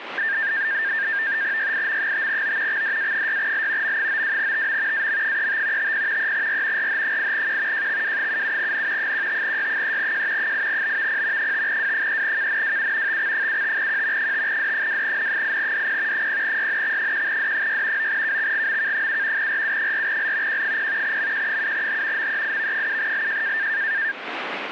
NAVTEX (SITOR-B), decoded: YIM5O XDA6L M92TM AM35 50 3R RH8Q JXW77N 15Y3J 8BVP 5W3KNWU TX75Q 5D2N8DP 0YNX1D6 9KXGMK7 RU4L Q0 MQ7H MEIV7LJ

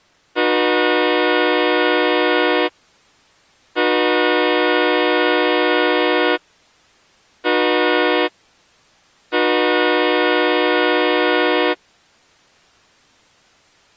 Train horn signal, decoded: 2 long, 1 short, 1 long

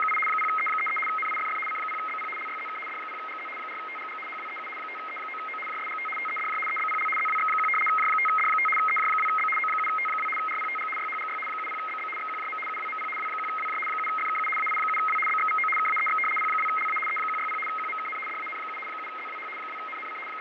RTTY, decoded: … 0E33 NIFF C0BP LYZK D0GZ 4TGG HWEU 5E9O JSGT TEDJ EBPL ZWX1 J5D5 EJ2B O7T2 RPTG YHGY 70BB XQJM UWMP W1WJ 7FKU AI7W BXVO KAEX P2LA E160 QMKN DAN7 7ZWH 2NNC …

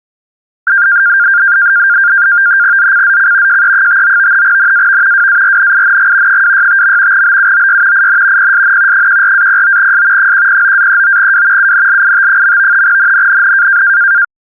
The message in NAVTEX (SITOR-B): ZCZC JE59 NAV WARNING 265. BUOY IN PSN 14-09S 109-39W UNLIT. NNNN

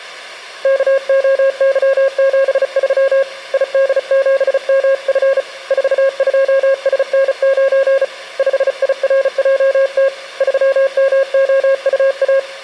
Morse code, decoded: KOY73 ID7MF 42SN9 5IRJT 3MOUA

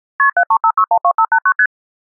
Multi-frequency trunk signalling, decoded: KP 735612589 ST

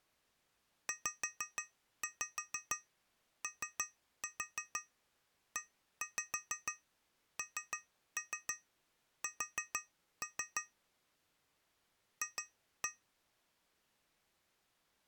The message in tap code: ZOENS F

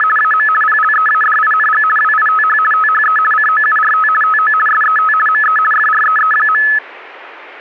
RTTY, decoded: … AM PLEADING WITH THE COURT TO SET ME FREE.

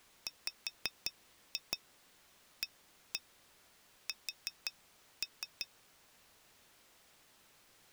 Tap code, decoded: WAS

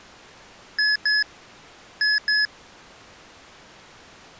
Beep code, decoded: 2-2

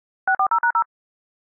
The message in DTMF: 640#0

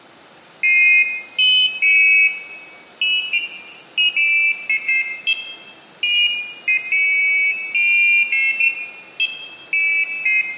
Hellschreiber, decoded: none

